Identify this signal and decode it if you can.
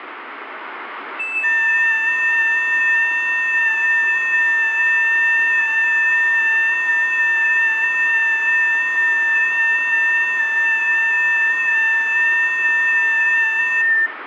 FT8 (several signals at once), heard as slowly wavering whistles, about 6.25 baud, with room echo.